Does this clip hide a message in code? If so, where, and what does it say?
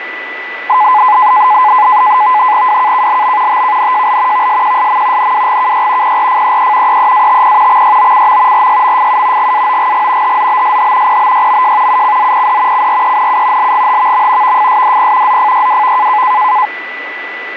Yes: NAVTEX (SITOR-B), 100 baud, 170 Hz shift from 0.7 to 16.7 s, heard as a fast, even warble, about 930 Hz centre, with radio static and a steady whistle near 1980 Hz. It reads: WKKLB TKNJL VSQSM NWGKY PRFEE EEATP XYOCM RYMFU GAOGG HZBSH PBYMJ UCZPD CRENU LGHVM VFSDP ZFYWV